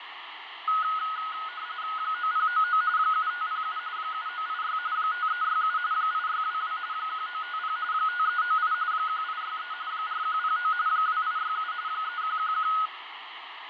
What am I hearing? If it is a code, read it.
RTTY (45.45 baud, 170 Hz shift), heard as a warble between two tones, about 1360 Hz centre, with radio static and fading. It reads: 9099 7507 7986 5367 8622 1950 5398 1863 4109 2867 3111